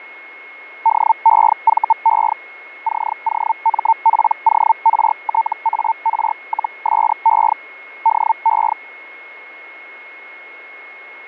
Hellschreiber (Feld-Hell, 122.5 baud), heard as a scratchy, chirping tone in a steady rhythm, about 900 Hz, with a steady whistle near 2170 Hz. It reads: DEVE COMPORTAR-SE DE